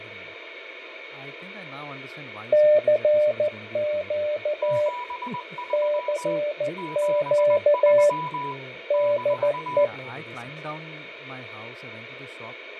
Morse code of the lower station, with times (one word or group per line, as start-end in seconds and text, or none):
2.5-4.9 CQ
5.7-8.1 CQ
8.9-9.8 DE